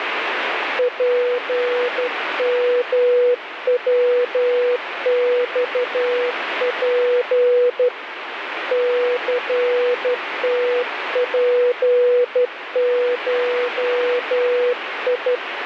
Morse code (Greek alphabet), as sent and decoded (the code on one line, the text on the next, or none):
.--. -- .-- -..- .--. / -.-. - .--. ---- ..
ΠΜΩΞΠ ΘΤΠΧΙ